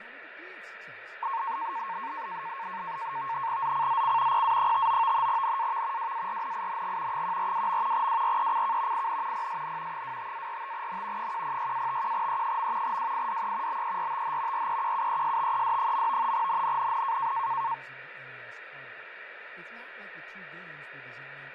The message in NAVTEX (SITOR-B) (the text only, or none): ZCZC PA59 NAV WARNING 142. WRECK IN PSN 25-45N 106-51E. WIDE BERTH REQUESTED. NNNN